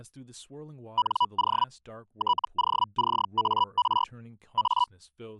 Hellschreiber (Feld-Hell, 122.5 baud), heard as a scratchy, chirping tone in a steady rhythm, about 980 Hz, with speech in English. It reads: NO TOCAR A